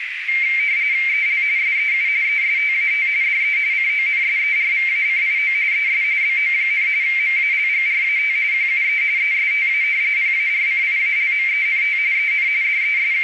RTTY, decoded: EL SEU ESTAT DE CONSERVACIO ES BO, MALGRAT QUE ESTA PARCIALMENT EN …

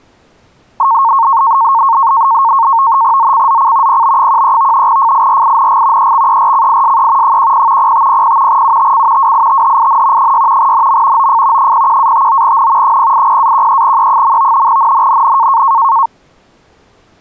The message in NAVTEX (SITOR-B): ZCZC PB13 FIRING EXERCISE 10 0500 UTC WITHIN 6 NM OF 01-59N 080-13E. NNNN

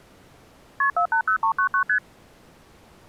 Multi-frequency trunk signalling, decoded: KP 480399 ST

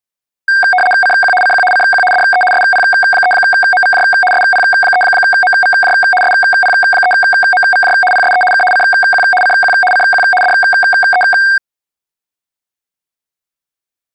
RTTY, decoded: CQ CQ CQ DE SP3MVJ SP3MVJ SP3MVJ PSE K CQ CQ CQ DE

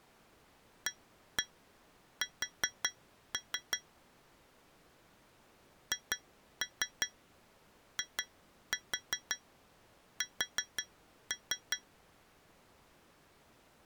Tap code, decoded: AS HIS

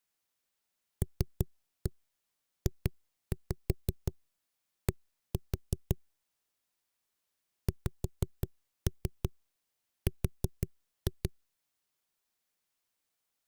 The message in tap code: LJD XR

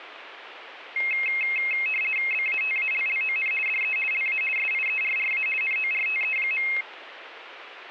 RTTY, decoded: BATALLON DE LA SIERRA NORTE.

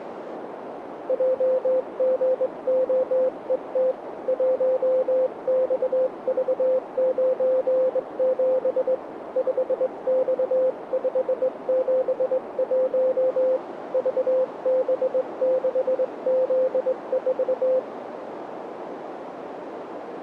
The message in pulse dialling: none

